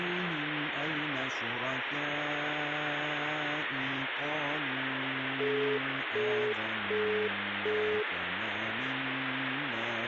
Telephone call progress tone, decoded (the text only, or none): busy tone